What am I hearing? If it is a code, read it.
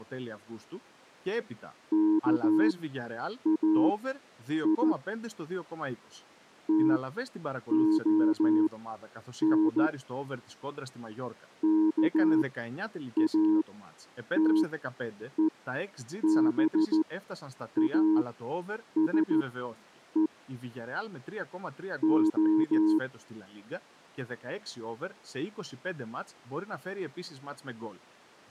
Morse code (Greek alphabet), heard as a keyed tone, machine-sent, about 14 wpm, spaced as for 8 wpm, 320 Hz. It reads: ΚΑΙ ΤΟΝ ΚΑΤΕΒΑΣΕ Ο